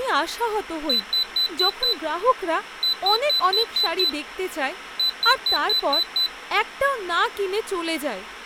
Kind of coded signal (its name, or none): beep code